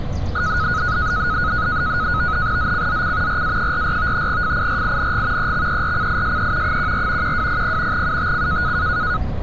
NAVTEX (SITOR-B), 100 baud, 170 Hz shift, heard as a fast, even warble, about 1360 Hz centre, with street noise. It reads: ZCZC RA44 FIRING EXERCISE 14 1200 UTC